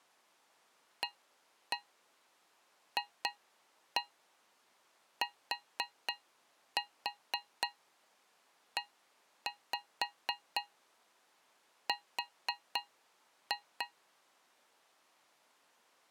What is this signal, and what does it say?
Tap code, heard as taps on a metal pipe, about 4 knocks a second. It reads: AFTER